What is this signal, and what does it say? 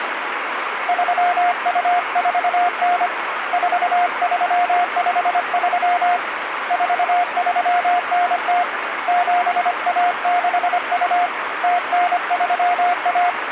Morse code (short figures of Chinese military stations), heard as a keyed tone, hand-sent with a paddle, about 25 wpm, 710 Hz, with radio static. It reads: 3249 4353 4390 7162 0931